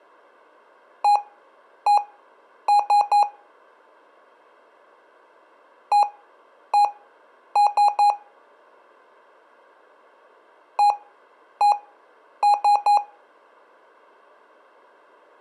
Beep code, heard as beeps from a small speaker, played three times, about 820 Hz. 1-1-3. In Phoenix BIOS tables: CMOS read or write failure.